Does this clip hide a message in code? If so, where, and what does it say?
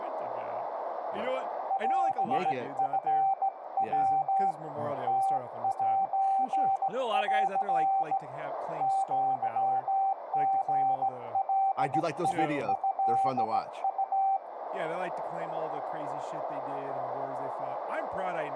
Yes: Morse code (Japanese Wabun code) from 1.6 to 14.4 s, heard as a keyed tone, hand-sent with a straight key, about 17 wpm, 780 Hz, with radio static, a narrow filter, room echo and speech in English. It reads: オチヤ ムセン アリガトウ